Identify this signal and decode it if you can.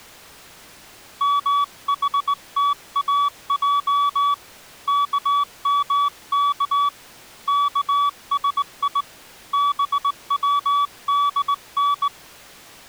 Morse code (Persian alphabet), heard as a keyed tone, hand-sent with a straight key, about 19 wpm, 1140 Hz. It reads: محتاج کمک کسی بودن